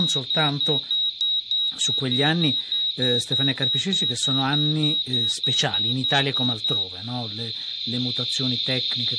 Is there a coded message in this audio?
No, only evenly repeated beeps, with radio static, a narrow filter, room echo and speech in Italian.